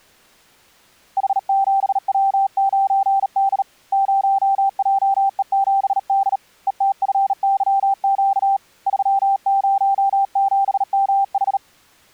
Morse code, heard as a keyed tone, hand-sent with a bug key, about 38 wpm, 780 Hz. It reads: H7W9D 0JE7D ETFYQ 307MH